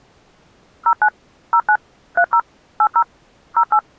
DTMF, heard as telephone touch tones, dialled by machine, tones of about 70 ms. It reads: 09 09 30 80 08